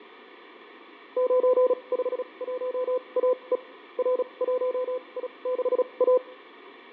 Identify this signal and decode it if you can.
Morse code, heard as a keyed tone, machine-sent, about 36 wpm, spaced as for 27 wpm, 500 Hz, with radio static and fading. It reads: 951AE R1I6A